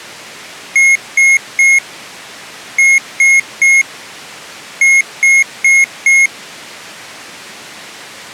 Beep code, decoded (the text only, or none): 3-3-4